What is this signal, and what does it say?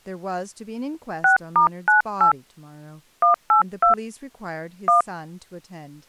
DTMF, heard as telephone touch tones, dialled by hand, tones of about 110 ms, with speech in English. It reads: 6*98 182 1